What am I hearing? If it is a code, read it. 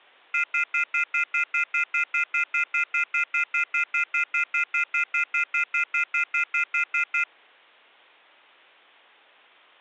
Telephone call progress tone (North American plan), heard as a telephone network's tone, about 1400, 2050, 2450, 2600 Hz, 0.1 s on and 0.1 s off. Off-hook warning tone.